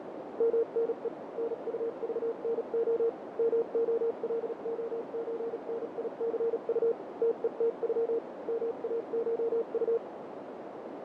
Morse code (Russian alphabet), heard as a keyed tone, machine-sent, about 37 wpm, spaced as for 33 wpm, 460 Hz, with heavy radio static, fading and a narrow filter. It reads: МНЕ НУЖНО МОЛОЧНИЦУ ТЕТЮ МАШУ